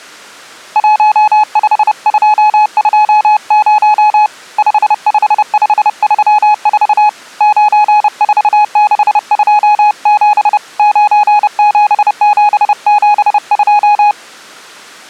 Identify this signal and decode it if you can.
Morse code, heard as a keyed tone, hand-sent with a paddle, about 30 wpm, 840 Hz. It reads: 15220 55534 94627 97772